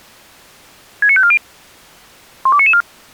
Five-tone selective call (ZVEI), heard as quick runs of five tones, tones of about 70 ms. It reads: 69540 12994